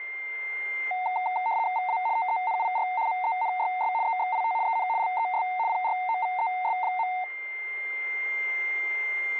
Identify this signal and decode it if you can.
RTTY (75 baud, 170 Hz shift), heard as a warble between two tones, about 820 Hz centre, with a steady whistle near 2100 Hz. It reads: VA TENIR MENYS EXIT EN LES PROVES.